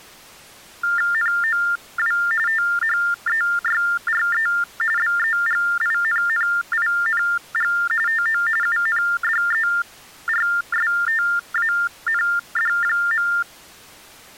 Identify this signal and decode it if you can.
TTY/TDD text telephone tones (45.45 baud Baudot), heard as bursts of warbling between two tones, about 400 Hz shift, 1600 Hz centre. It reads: NOW THEYRE BEGINNING TO UNDERSTAND.